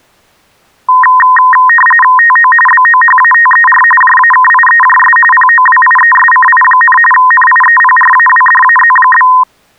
RTTY (45.45 baud, 850 Hz shift), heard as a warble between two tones, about 1440 Hz centre. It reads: TO BOHATER JAKIEJS POWIESCI, NIEPRAWDAZ?